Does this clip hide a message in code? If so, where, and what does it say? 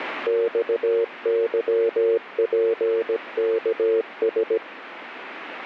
Yes: Morse code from 0.2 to 4.6 s, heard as a keyed tone, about 17 wpm, 460 Hz, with radio static. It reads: XYPKS